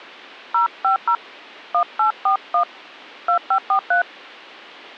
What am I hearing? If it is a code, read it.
DTMF, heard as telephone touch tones, dialled by hand, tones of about 90 ms. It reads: 050 1841 2543